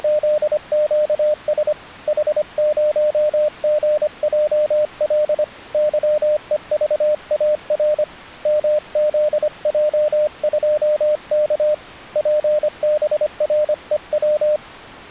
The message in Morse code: … H0GJL YEVAR MZJ2K PBREW

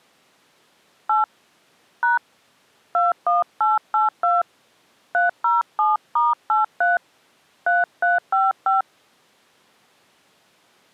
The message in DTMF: 8 # 21882 307*83 3355

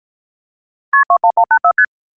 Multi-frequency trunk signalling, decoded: KP 21184 ST

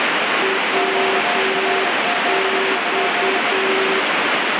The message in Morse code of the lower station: WX

